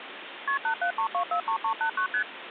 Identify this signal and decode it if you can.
Multi-frequency trunk signalling (R1, as on North American trunks), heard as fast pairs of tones, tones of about 90 ms, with phone line noise. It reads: KP 873243389 ST